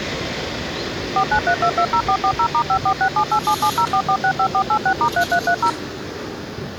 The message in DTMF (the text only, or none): 493220440*546787704465486*3330